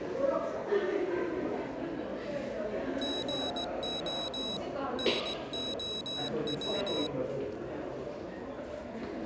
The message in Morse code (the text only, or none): GO NOW